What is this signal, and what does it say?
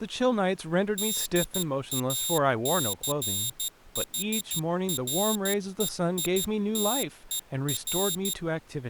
Morse code, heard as a high beeper, hand-sent with a paddle, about 13 wpm, 3700 Hz, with speech in English. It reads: DACHREITER